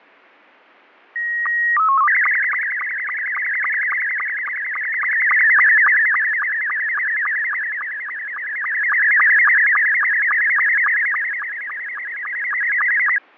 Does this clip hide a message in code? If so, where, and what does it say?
Yes: SSTV (slow-scan television), Scottie S2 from 1.2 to 13.2 s, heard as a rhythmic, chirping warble, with fading.